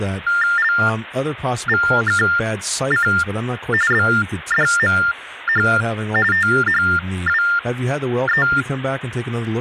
TTY/TDD text telephone tones (45.45 baud Baudot), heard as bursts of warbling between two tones, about 400 Hz shift, 1600 Hz centre, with phone line noise and speech in English. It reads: LVKC BDMH THWE